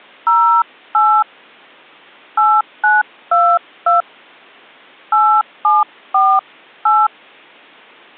DTMF, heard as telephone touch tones, dialled by hand, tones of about 250 ms. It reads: 08 8922 8748